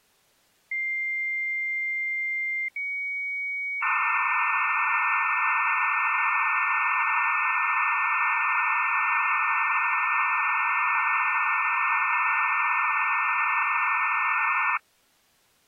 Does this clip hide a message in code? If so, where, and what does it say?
Yes: dial-up modem handshake (low-speed, two carriers) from 0.7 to 14.8 s, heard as two whistles, then hiss.